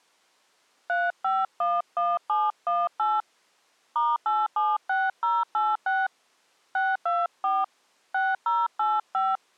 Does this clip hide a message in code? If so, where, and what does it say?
Yes: DTMF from 0.9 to 9.4 s, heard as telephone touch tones, dialled by hand, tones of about 210 ms. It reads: 3511718 *876086 624 6085